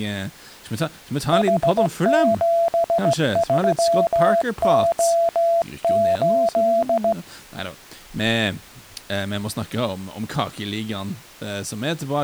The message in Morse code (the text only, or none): H73O8